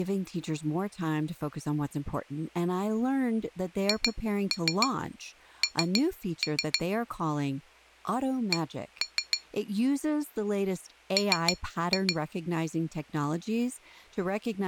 Tap code, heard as taps on glass, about 6 knocks a second, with speech in English. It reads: HN C M